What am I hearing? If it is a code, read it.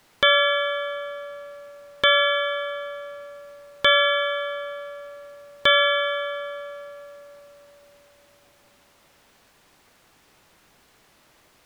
Clock strike, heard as a bell. 4. Four o'clock.